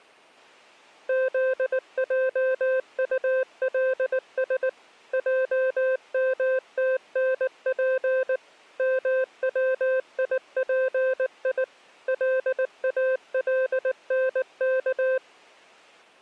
Morse code, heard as a keyed tone, machine-sent, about 19 wpm, 520 Hz. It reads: ZJULS JMTNP MWIPI LALNK